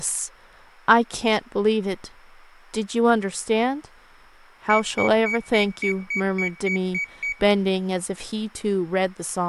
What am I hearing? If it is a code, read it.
Beep code, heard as a piezo beeper, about 2250 Hz, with room echo and speech in English. 10 short. In AMI BIOS tables: CMOS shutdown register error.